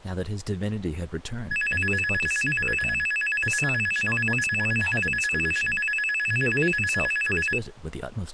A tone that alternates evenly between two pitches, with speech in English. There is no code.